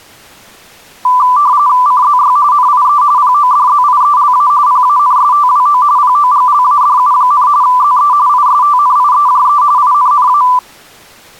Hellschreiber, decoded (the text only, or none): none